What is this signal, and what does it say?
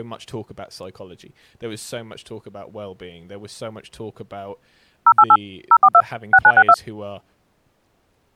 DTMF, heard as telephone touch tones, dialled by machine, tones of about 60 ms, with speech in English. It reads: 088 042 6962